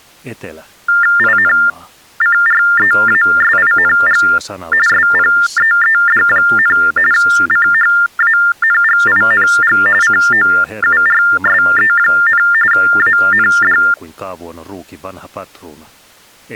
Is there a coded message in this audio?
Yes: TTY/TDD text telephone tones (45.45 baud Baudot) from 0.9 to 13.9 s, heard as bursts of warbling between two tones, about 400 Hz shift, 1600 Hz centre, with speech in Finnish. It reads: INCREASING SPEED, CHANGING COURSE, AND